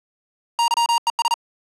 Morse code, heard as electronic beeps, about 40 wpm, 940 Hz. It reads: YES